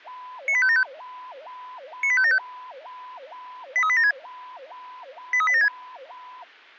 Five-tone selective call (ZVEI), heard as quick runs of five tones, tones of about 70 ms. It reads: 98575 98575 83876 83876